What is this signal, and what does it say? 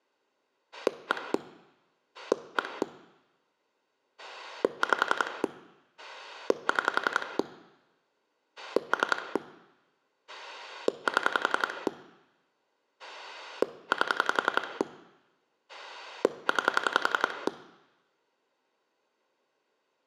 Pulse dialling, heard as a rotary dial, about 11 pulses a second, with room echo. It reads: 1 1 5 6 3 7 8 9